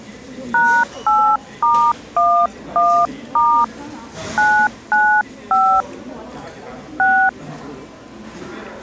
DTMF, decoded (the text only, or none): #8*11* 995 6